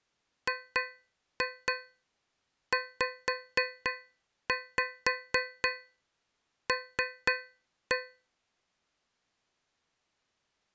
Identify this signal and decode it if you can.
Tap code, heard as taps on a metal pipe, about 4 knocks a second. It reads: GZL